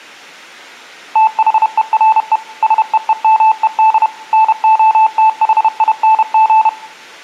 Morse code, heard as a keyed tone, machine-sent, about 31 wpm, 880 Hz, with room echo. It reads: THERE SEEMED NOTHING